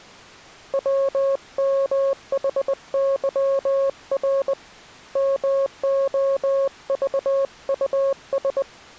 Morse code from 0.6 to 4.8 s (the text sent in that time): WMHYR